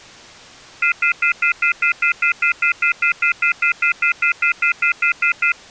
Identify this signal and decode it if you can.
Telephone call progress tone (North American plan), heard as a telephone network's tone, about 1400, 2050, 2450, 2600 Hz, 0.1 s on and 0.1 s off. Off-hook warning tone.